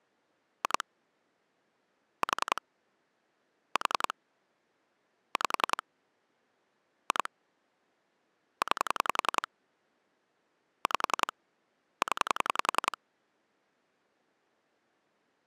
Pulse dialling, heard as clicks on a phone line, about 10 pulses a second. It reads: 2 4 4 5 2 9 5 0